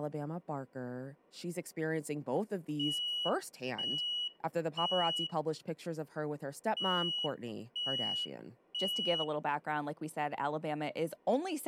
Alarm pattern, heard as an alarm's beeps, played twice, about 2900 Hz, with speech in English. Temporal three. Smoke or fire, evacuate.